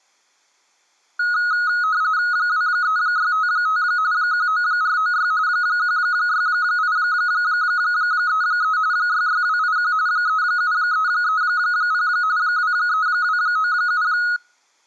RTTY (45.45 baud, 170 Hz shift), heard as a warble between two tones, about 1360 Hz centre. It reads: 23655 19496 16833 66281 37330 23297